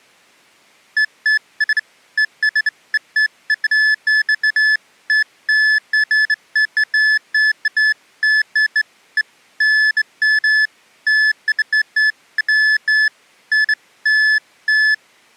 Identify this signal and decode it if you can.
Beeps of irregular length. There is no code.